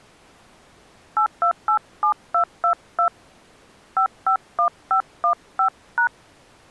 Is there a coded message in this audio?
Yes: DTMF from 1.2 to 6.1 s, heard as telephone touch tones, dialled by hand, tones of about 90 ms. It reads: 8287222 551515#